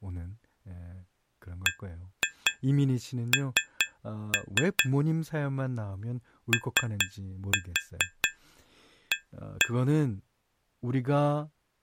Tap code, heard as taps on glass, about 4 knocks a second, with speech in Korean. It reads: BN OA